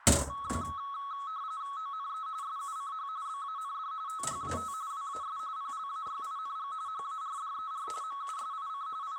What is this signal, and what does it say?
RTTY (45.45 baud, 170 Hz shift), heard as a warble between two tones, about 1200 Hz centre, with radio static, a narrow filter and the noise of a restroom. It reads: ONE SUCH BAND THAT WAS PLAYING HARDER MUSIC …